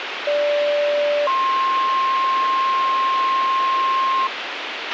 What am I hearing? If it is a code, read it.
Two-tone page, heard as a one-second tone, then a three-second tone, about 580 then 1060 Hz, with radio hiss and a squelch burst at the end.